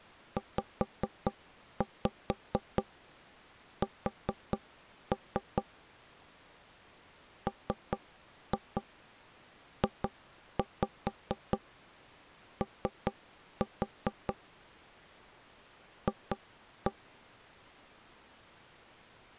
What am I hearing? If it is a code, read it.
Tap code, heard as knocks on wood, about 4 knocks a second. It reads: ZS MJO F